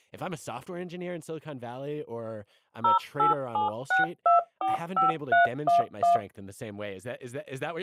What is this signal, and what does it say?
DTMF, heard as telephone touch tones, dialled by machine, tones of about 140 ms, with speech in English. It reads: 0876245311